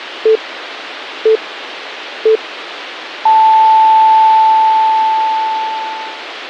Radio time signal (three low pips and a long one an octave up, as on NHK), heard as pips.